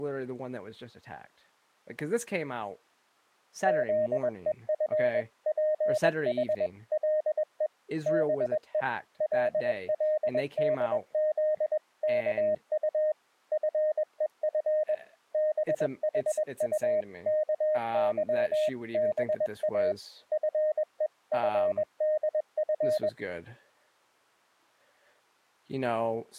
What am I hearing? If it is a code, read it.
Morse code (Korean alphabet), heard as a keyed tone, machine-sent, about 21 wpm, 620 Hz, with speech in English. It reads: 탄주가 다 끝이 난 뒤에도 나는